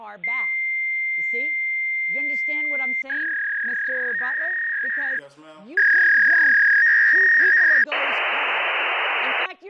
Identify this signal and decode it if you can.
Fax machine handshake, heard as a long tone, a warble and hiss, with speech in English.